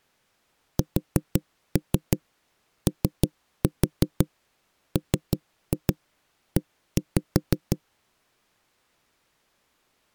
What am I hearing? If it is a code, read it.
Tap code, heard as knocks on wood, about 6 knocks a second. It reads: SOME